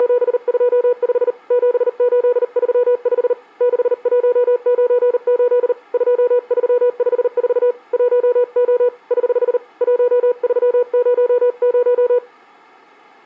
Morse code, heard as a keyed tone, hand-sent with a paddle, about 39 wpm, 490 Hz. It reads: … 7835 6198 2354 1O <HH> 1300